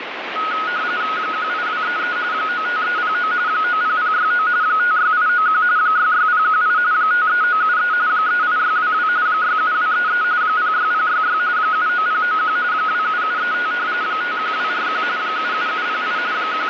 RTTY (45.45 baud, 170 Hz shift), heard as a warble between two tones, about 1360 Hz centre, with radio static. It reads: 18233 95309 90069 56891 66018 53973 38622 67233 06066 79091 27735 51241 77708 …